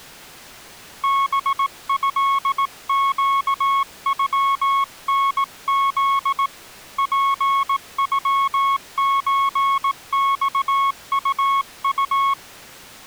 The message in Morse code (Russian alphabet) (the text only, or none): БЭЩЮНЗ ПЮЧЬУУ